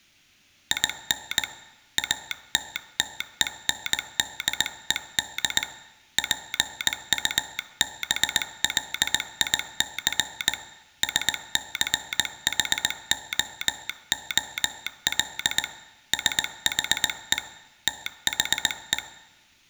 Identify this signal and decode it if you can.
Morse code, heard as a telegraph sounder, hand-sent with a bug key, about 19 wpm. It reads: IN ATTENDED PUBLIC SCHOOL SHE THE